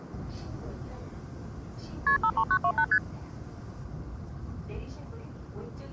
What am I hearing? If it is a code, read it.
Multi-frequency trunk signalling (R1, as on North American trunks), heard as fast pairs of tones, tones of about 70 ms, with the noise inside a subway train. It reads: KP 53928 ST